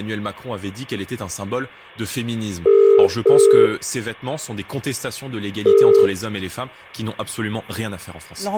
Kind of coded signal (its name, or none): telephone call progress tone